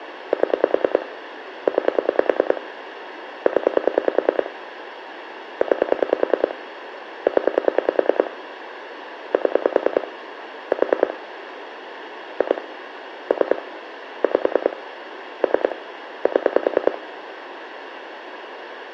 Pulse dialling, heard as clicks on a phone line, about 10 pulses a second, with phone line noise and room echo. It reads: 7 9 0 9 0 7 4 2 3 5 3 7